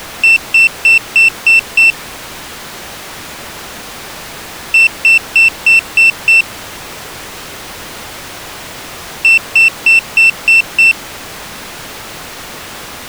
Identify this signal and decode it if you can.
Beep code, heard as a piezo beeper, played three times, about 2700 Hz. 6 short. In AMI BIOS tables: keyboard controller gate A20 failure; in Dell tables: video card failure.